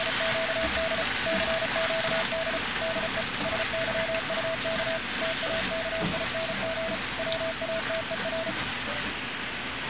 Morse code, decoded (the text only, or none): … CQD DE SYUK TAKING WATER